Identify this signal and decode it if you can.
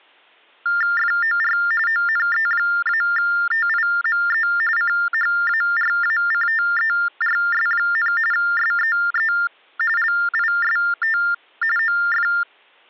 TTY/TDD text telephone tones (45.45 baud Baudot), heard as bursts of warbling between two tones, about 400 Hz shift, 1600 Hz centre. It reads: FOR ONE-TIME CHARACTERS, SEE LIST OF